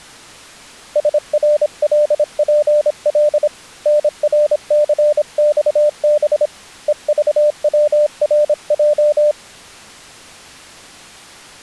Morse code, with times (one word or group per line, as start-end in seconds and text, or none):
1.0-3.5 SRLPL
3.9-6.5 NRCXB
6.9-9.3 EVWRJ